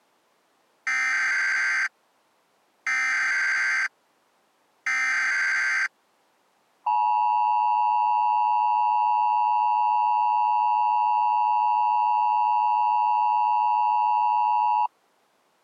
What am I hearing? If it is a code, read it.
Emergency Alert System (SAME) tones (header bursts, then the 853 and 960 Hz attention tone), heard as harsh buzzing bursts, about 520.83 baud.